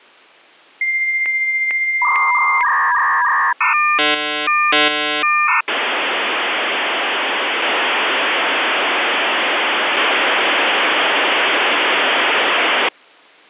Dial-up modem handshake (V.34 or later), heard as a whistle, warbles, then hiss.